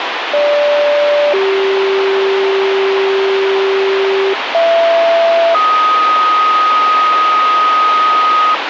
Two-tone page, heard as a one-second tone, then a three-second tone, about 580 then 390 Hz, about 670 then 1250 Hz, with radio hiss.